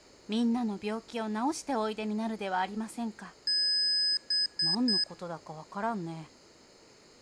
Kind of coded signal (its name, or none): beep code